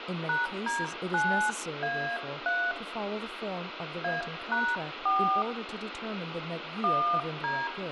DTMF, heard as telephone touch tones, dialled by hand, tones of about 270 ms, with phone line noise, room echo and speech in English. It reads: #D9A3 A#4 1D